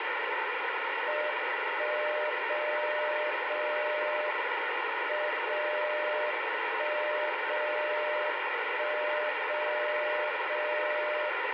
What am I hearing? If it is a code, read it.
Radio time signal (WWVB), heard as a tone whose level steps once a second, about 600 Hz, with radio static. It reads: 1 0 0 M 0 1 0 1 0 0